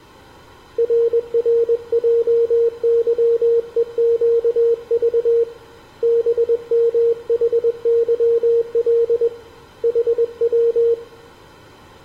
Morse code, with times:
0.8-5.4 RRJYEQV
6.0-9.3 BMHYL
9.8-10.9 HW

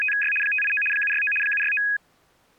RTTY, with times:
0.0-0.3 …
0.4-0.8 589
0.9-1.3 769
1.4-1.8 769

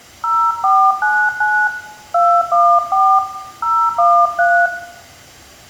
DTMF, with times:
0.2-1.7 0499
2.1-3.2 214
3.6-4.7 013

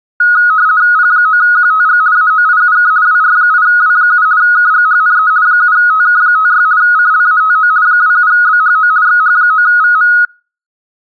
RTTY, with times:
1.0-2.0 P9QTG
2.2-2.9 AOIUK
3.1-4.3 WR8W7
4.4-5.3 KGHNE
5.5-6.7 7TK56
6.8-7.7 CLATO
7.9-8.9 27BHO
9.1-10.1 XH9VM

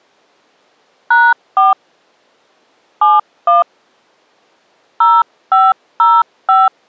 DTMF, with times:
1.1-1.7 #4
3.0-3.6 71
5.0-6.7 0505

